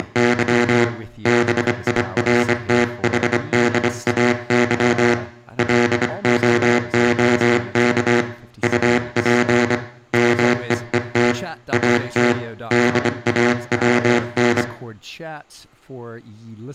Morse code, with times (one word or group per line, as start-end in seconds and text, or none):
0.0-0.8 …
1.3-5.1 BIRTHDAY
5.6-8.2 LOOK
8.6-9.7 UP
10.1-11.3 MEET
11.7-12.3 AT
12.7-14.6 DAWN